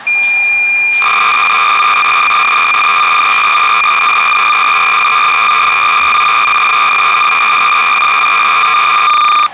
Cassette data (Kansas City type), 300 baud, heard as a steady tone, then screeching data, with the noise of a restroom.